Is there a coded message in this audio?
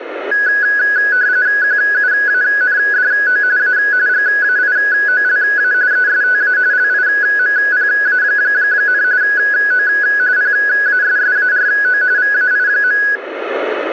Yes: RTTY (45.45 baud, 170 Hz shift) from 0.3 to 13.2 s, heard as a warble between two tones, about 1600 Hz centre. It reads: QUANDO A GAIOLA ESTA LIMPA, O PASSARO VAI.